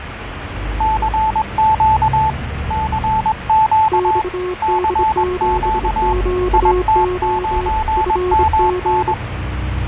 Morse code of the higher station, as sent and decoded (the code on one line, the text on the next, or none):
-.-. --.- / -.-. --.- / -.-. --.- / .. - ----. -- -.
CQ CQ CQ IT9MN